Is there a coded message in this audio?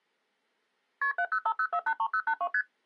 Yes: multi-frequency trunk signalling (R1, as on North American trunks) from 1.0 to 2.6 s, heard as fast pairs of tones, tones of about 70 ms. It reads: KP 7050483082 ST